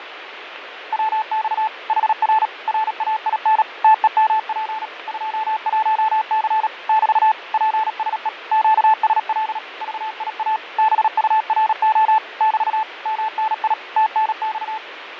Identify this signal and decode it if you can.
Morse code, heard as a keyed tone, machine-sent, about 37 wpm, 870 Hz, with radio static and fading. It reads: WX HR RAIN TEMP 21C <BT> PSE QSL VIA BURO <BT> MNI TNX